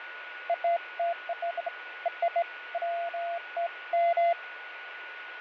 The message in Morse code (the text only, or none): none